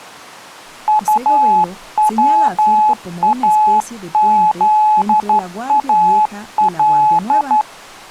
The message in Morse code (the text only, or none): UWAZAL